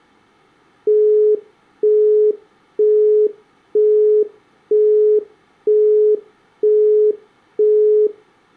Telephone call progress tone (single-tone plan, as in Europe, Japan and elsewhere), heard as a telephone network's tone, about 420 Hz, 0.48 s on and 0.48 s off. Busy tone.